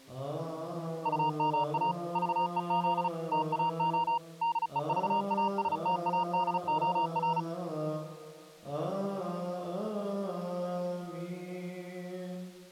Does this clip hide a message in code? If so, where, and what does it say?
Yes: Morse code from 1.0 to 7.5 s, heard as a keyed tone, machine-sent, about 35 wpm, 940 Hz. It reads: UMA VEZ TAO DEVASTADOR